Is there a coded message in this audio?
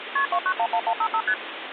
Yes: multi-frequency trunk signalling (R1, as on North American trunks) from 0.2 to 1.3 s, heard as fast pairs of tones, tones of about 70 ms, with phone line noise. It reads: KP 2911155 ST